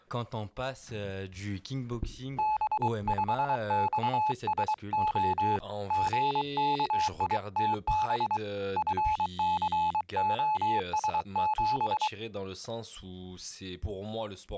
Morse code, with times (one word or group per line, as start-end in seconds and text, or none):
2.4-5.6 B5XSO
5.9-8.4 GKITB
8.8-12.1 FCOS7